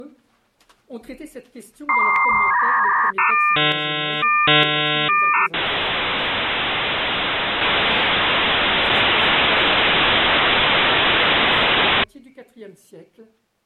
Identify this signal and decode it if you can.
Dial-up modem handshake (V.34 or later), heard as a whistle, warbles, then hiss.